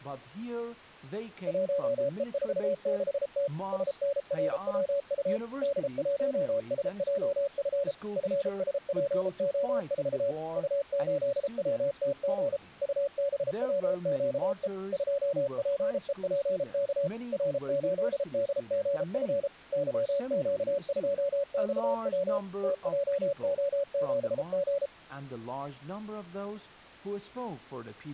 Morse code, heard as a keyed tone, machine-sent, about 33 wpm, 560 Hz. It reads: 1E46T SNRWU D1SJF FSPO4 U8WTG UBWQE 2PEPK R8DGF YQ2XW TJO7G